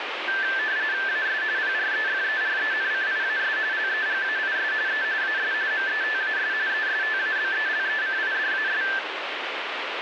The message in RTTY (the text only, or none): AS PREFERENCIAS LEGAIS E AS METAS ESTABELECIDAS